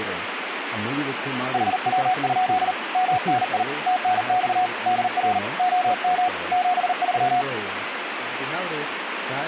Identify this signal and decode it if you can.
Morse code, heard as a keyed tone, hand-sent with a bug key, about 39 wpm, 730 Hz, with radio static and speech in English. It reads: HW? MNI TNX DR OM 73